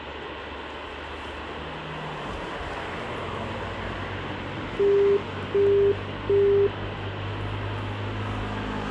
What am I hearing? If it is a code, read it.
Telephone call progress tone (as in the UK, Australia and similar networks), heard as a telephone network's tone, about 400 Hz, 0.375 s on and 0.375 s off, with phone line noise and street noise. Busy tone.